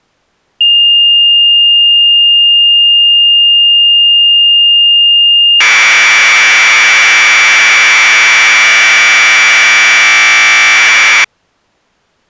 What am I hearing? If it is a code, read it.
Commodore tape loading (standard loader), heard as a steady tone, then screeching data.